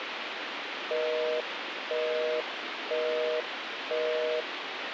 Telephone call progress tone (North American plan), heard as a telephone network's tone, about 480, 620 Hz, 0.5 s on and 0.5 s off, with phone line noise. Busy tone.